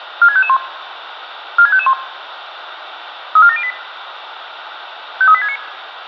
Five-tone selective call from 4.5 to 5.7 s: 53869

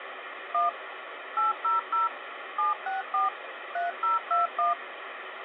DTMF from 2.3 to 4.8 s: 764 3021

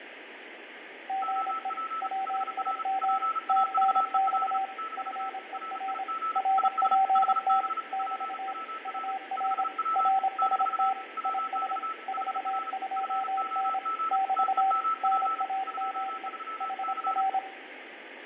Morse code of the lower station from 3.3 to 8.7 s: TNX FER RPT <BT>

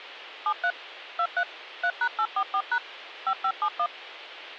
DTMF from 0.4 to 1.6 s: 73 23

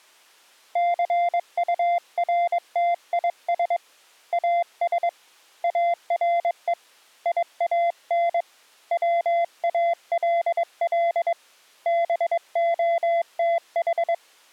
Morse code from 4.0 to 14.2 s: AS ARE IAN WALL BOTH

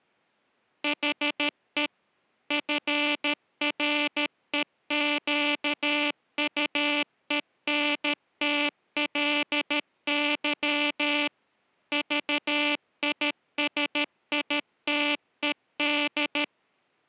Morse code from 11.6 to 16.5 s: VISITED

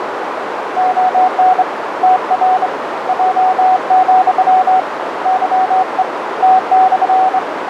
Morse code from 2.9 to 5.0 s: J,

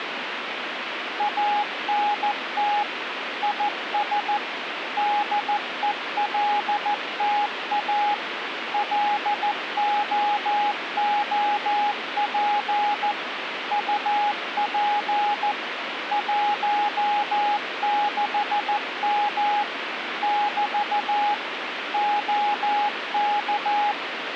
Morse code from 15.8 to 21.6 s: 16M <BT>

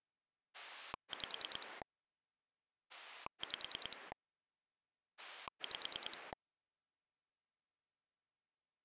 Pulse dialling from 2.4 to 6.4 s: 5 5

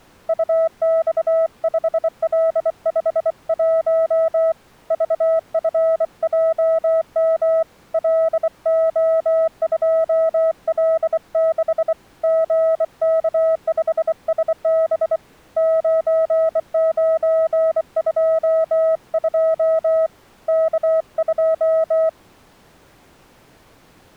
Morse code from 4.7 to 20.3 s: VFJM LO2L6 GK5SB 9922

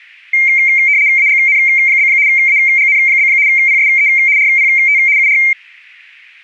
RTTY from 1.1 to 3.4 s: AGN? AGN?

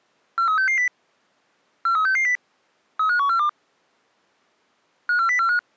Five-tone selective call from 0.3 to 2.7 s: 43660 43660

